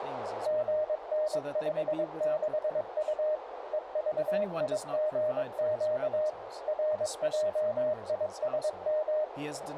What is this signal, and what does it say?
Morse code, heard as a keyed tone, machine-sent, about 22 wpm, 610 Hz, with radio static, a narrow filter and speech in English. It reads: GN56U EVIGQ RJISM